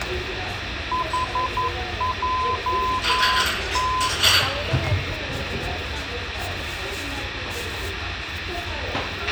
Morse code, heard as a keyed tone, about 11 wpm, 1020 Hz, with radio hiss, a squelch burst at the end, room echo and the noise of a restaurant. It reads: HJT